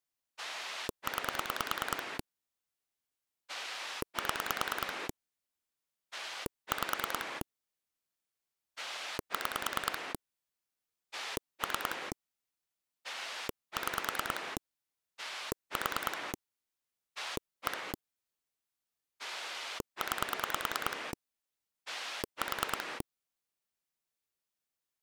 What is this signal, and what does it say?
Pulse dialling, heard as a rotary dial, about 9 pulses a second. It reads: 9 7 5 6 3 6 4 1 9 4